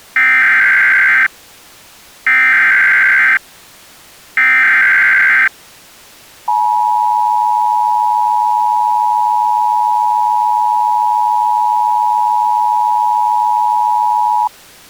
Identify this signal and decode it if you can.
Emergency Alert System (SAME) tones (header bursts, then the 853 and 960 Hz attention tone), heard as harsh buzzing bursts, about 520.83 baud.